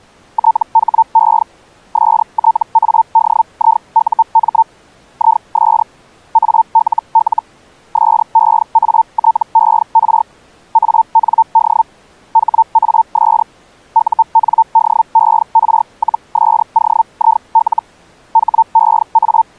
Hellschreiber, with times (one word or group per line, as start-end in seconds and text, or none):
0.3-1.4 THE
1.9-4.6 STADIUM
5.1-5.8 IS
6.3-7.4 ALL
7.9-10.2 SEATER
10.7-11.8 AND
12.3-13.4 HAS
13.9-17.8 UNDER-SOIL
18.3-19.6 …